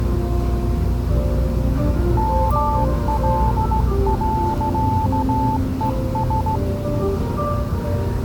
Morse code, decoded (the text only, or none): ML.ES